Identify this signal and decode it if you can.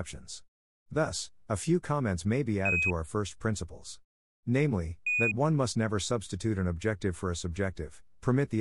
Quindar tones, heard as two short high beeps, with speech in English.